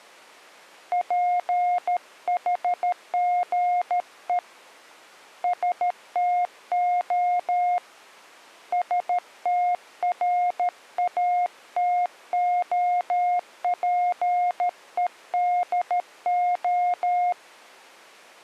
Morse code (Greek alphabet), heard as a keyed tone, hand-sent with a paddle, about 13 wpm, 710 Hz. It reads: ΠΗΓΕ ΣΤΟ ΣΤΡΑΤΟΠΕΔΟ